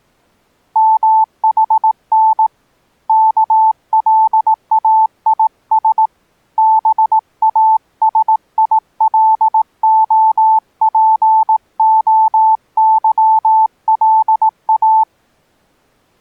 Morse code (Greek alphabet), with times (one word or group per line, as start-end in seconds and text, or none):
0.8-2.5 ΜΗΝ
3.1-6.1 ΚΛΑΙΣ
6.6-15.0 ΒΑΣΙΛΟΠΟΥΛΑ